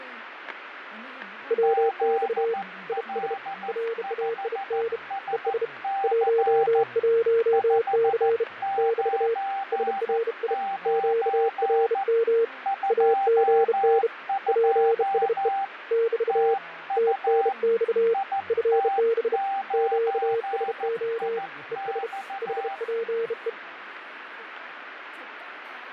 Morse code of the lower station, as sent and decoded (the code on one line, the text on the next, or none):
.-- -..- / .. ... / .-. .- .. -. / . ... / .---- .---- -.-. / -...- / ... .-. .. / --.- .-. -- / .- --. -. / .--. ... . / -...- / - -. -..- / ..-. -... / --.- ... --- / . ... / .... .--. .
WX IS RAIN ES 11C <BT> SRI QRM AGN PSE <BT> TNX FB QSO ES HPE